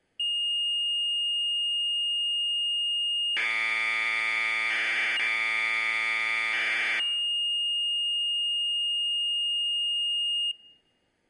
Commodore tape loading (standard loader), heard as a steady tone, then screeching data.